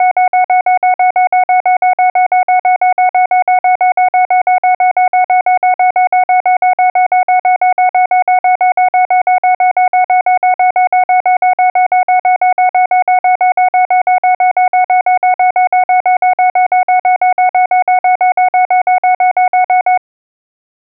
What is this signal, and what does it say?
Evenly repeated beeps. There is no code.